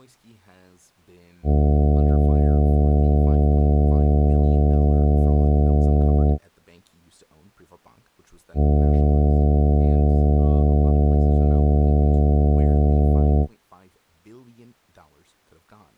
Ship horn signal, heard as a ship's horn, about 70 Hz, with speech in English. 2 long. At sea: a vessel under power that has stopped in fog.